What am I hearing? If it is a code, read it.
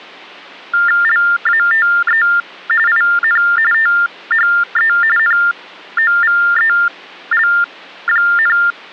TTY/TDD text telephone tones (45.45 baud Baudot), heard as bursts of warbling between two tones, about 400 Hz shift, 1600 Hz centre. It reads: LATE IN THE NOVEL,